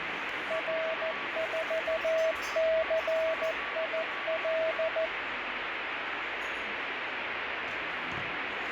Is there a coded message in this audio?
Yes: Morse code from 0.4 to 5.1 s, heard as a keyed tone, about 14 wpm, 650 Hz, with radio static, a weaker station near 1140 Hz and the noise of a crowd indoors. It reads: R4CIL